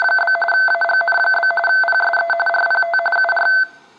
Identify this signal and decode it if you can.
RTTY (45.45 baud, 850 Hz shift), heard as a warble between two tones, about 1100 Hz centre. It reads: … AGN? PSE RPT UR